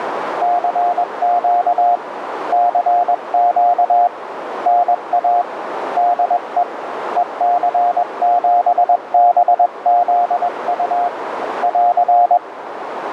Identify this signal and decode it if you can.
Morse code, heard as a keyed tone, hand-sent with a paddle, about 21 wpm, 710 Hz, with radio static and a narrow filter. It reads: CQ CQ NA DE EC7BZU <AR>